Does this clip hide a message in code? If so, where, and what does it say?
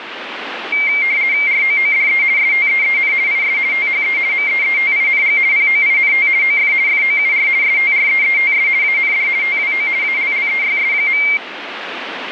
Yes: RTTY (50 baud, 170 Hz shift) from 0.7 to 11.4 s, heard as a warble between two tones, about 2200 Hz centre, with radio static. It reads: ROODE STEEN IS THE MEETING POINT OF FOUR STREETS AND TWO ALLEYS.